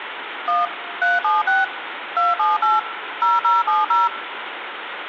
DTMF, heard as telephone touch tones, dialled by machine, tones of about 180 ms, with phone line noise and room echo. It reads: 1 376 278 0070